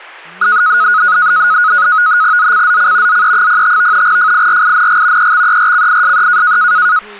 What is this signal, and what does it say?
NAVTEX (SITOR-B), 100 baud, 170 Hz shift, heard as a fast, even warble, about 1360 Hz centre, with speech in Dogri. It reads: ZCZC ZE05 FIRING EXERCISE